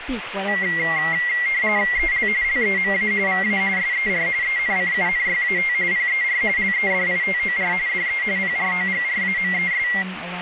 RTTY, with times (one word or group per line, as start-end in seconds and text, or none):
2.0-2.3 EL
2.4-3.1 LEMA
3.3-3.6 VA
3.8-4.3 SER
4.4-5.7 ENCUNYAT
5.9-6.4 PER
6.6-7.7 LEDITOR
7.9-8.2 DE
8.4-9.9 PROGRAMES